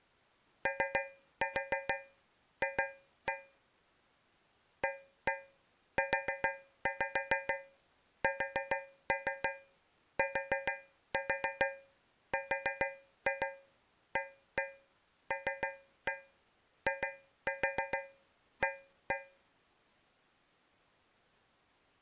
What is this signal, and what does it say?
Tap code, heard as taps on a metal pipe, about 6 knocks a second. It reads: OF AUSTRALIA